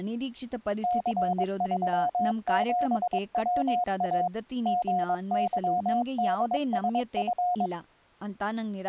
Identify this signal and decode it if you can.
Morse code, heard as a keyed tone, machine-sent, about 22 wpm, 720 Hz, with speech in Kannada. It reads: C37WA GYDSF